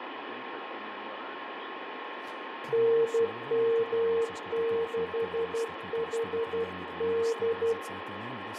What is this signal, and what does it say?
Morse code, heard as a keyed tone, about 12 wpm, 460 Hz, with radio static, a steady whistle near 1070 Hz and room echo. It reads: NM6HD